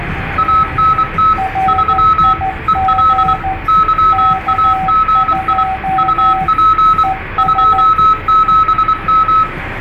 Morse code, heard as two keyed tones, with radio static, room echo and the noise inside a car. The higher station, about 24 wpm, 1290 Hz: ANT 3 EL YAGI UP 27M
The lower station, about 14 wpm, 760 Hz: RIG K2 ES